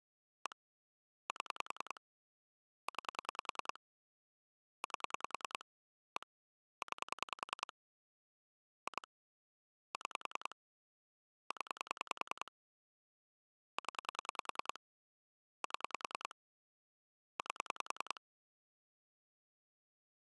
Pulse dialling, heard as clicks on a phone line, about 10 pulses a second. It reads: 1 7 9 8 1 9 2 6 0 0 7 8